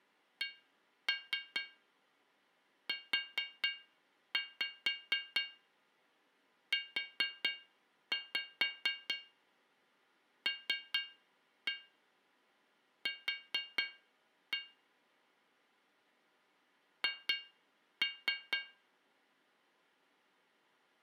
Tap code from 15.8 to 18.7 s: H

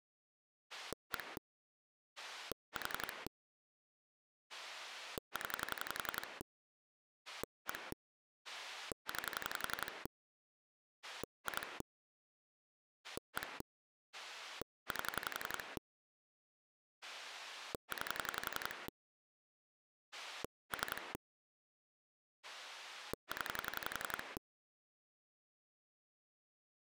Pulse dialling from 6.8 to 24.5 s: 1 9 2 1 8 9 3 0

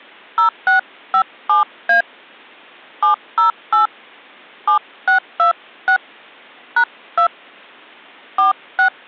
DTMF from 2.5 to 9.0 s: 708 7626 #2 46

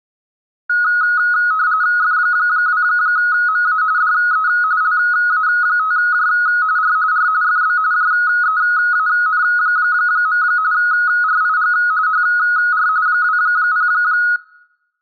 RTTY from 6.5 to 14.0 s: R R FB JEAN. RIG HR 20

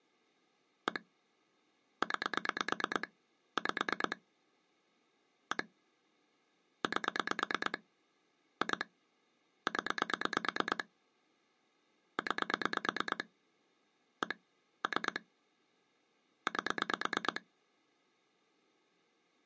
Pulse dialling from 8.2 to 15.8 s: 2 0 9 1 3

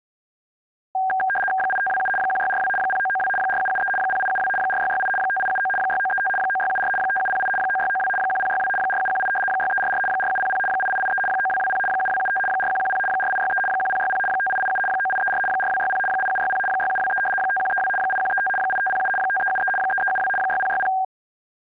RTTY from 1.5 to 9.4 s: 8527 1642 0992 4773 0872 4668 5879 6935 9674 5708 9692 1062 4718

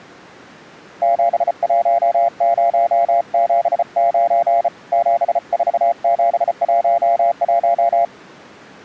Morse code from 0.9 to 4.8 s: 71079

